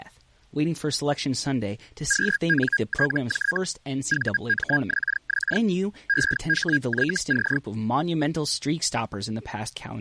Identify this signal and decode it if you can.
Hellschreiber (Feld-Hell, 122.5 baud), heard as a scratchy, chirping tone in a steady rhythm, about 1650 Hz, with speech in English. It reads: QNTJ VMXX EHYC